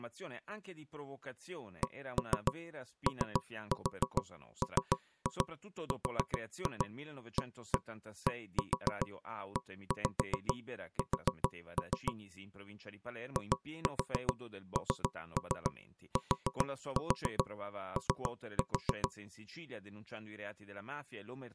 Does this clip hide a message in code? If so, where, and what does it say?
Yes: tap code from 1.8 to 19.1 s, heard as knocks on wood, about 7 knocks a second, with speech in Italian. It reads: COMRADES INTO